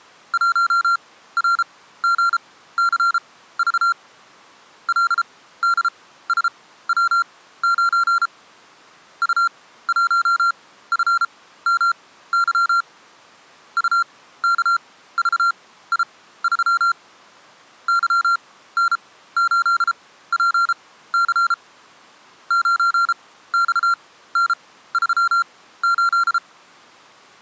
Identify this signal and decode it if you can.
Morse code, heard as electronic beeps, machine-sent, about 33 wpm, spaced as for 16 wpm, 1380 Hz. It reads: 1RGCV LDSW9 U1FMY UKVI3 YN8PC 9XN38